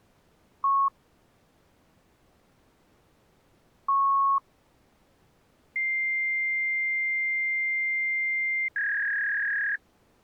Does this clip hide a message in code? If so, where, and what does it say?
Yes: fax machine handshake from 0.6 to 9.8 s, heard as a beep, a long tone and a warble.